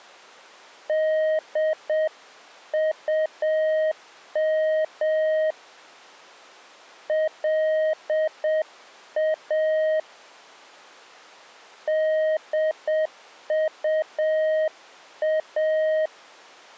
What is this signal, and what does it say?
Morse code, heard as a keyed tone, hand-sent with a paddle, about 7 wpm, 630 Hz. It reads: DUM LA DUA